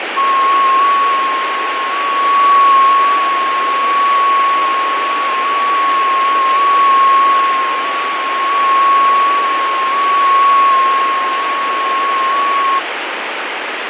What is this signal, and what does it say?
FT8 (one signal), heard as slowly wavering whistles, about 6.25 baud, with radio static and fading.